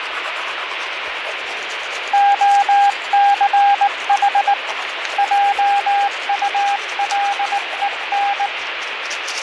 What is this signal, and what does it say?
Morse code, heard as a keyed tone, hand-sent with a paddle, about 19 wpm, 800 Hz, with radio static and the noise of a restroom. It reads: OCH JULEN